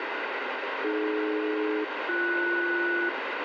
Aircraft SELCAL, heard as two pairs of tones, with heavy radio static. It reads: AD-BS